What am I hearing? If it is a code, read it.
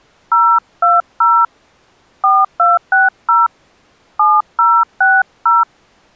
DTMF, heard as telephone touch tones, dialled by hand, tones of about 220 ms. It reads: 020 4260 7060